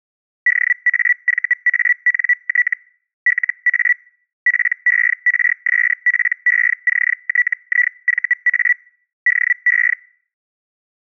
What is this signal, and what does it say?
Hellschreiber (Feld-Hell, 122.5 baud), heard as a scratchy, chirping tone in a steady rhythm, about 1950 Hz. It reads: DAVANT LA PERSPECTIVA DE